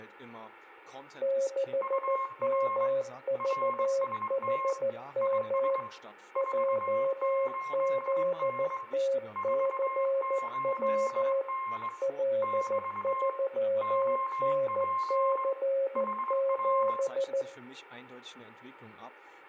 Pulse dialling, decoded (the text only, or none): none